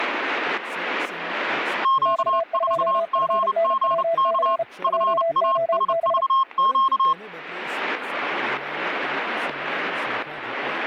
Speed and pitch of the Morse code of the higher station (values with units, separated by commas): 30 wpm, 1070 Hz